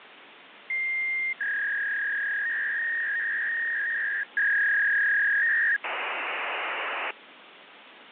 Fax machine handshake, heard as a long tone, a warble and hiss, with phone line noise.